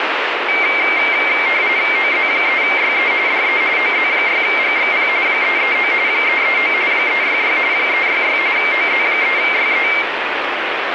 RTTY (45.45 baud, 170 Hz shift), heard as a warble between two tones, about 2200 Hz centre, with radio static. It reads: OZ3YE DE OZ6GXP 339 339 366 366 OZ3YE